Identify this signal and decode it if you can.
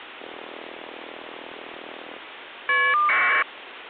Caller ID data burst, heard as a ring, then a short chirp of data, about 1200 baud, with phone line noise.